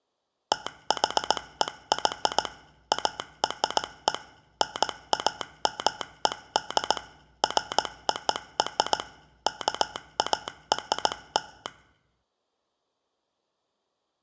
Morse code (American railroad code), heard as a telegraph sounder, machine-sent. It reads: THEY ARE NAMED FOR KARL